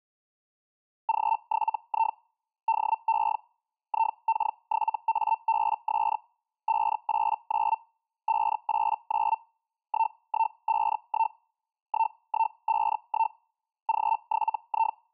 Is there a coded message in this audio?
Yes: Hellschreiber (Feld-Hell, 122.5 baud) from 1.1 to 15.0 s, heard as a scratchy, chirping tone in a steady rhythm, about 900 Hz. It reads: G7I DE IK7ABS 589 589 1151 1151 G7I